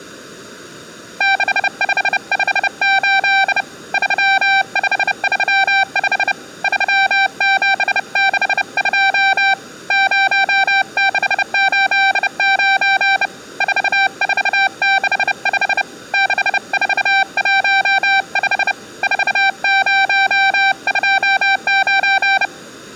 Morse code, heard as a keyed tone, hand-sent with a bug key, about 30 wpm, 780 Hz, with room echo. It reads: 6558 3535 3762 0689 4465 6415 4029